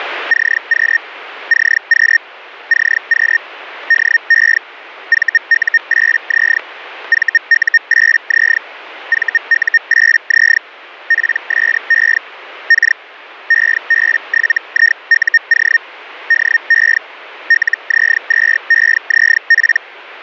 Hellschreiber (Feld-Hell, 122.5 baud), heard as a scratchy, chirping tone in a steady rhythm, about 1850 Hz, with radio static. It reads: CQ CQ CQ DE VU8Z VU8Z VU8Z PSE K EB7IUO DE LZ2EZP